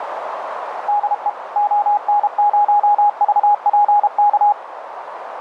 Morse code, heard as a keyed tone, machine-sent, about 32 wpm, 830 Hz, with radio static and a narrow filter. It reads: DE ON0VPK